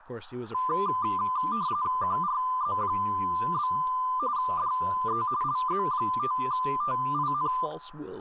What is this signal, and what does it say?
RTTY (45.45 baud, 170 Hz shift), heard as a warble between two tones, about 1100 Hz centre, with static crashes, room echo and speech in English. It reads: QRZ? DE LZ5TIN